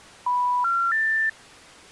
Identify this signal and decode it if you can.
Telephone call progress tone (North American plan), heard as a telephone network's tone, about 980, 1370, 1800 Hz. Special information tone.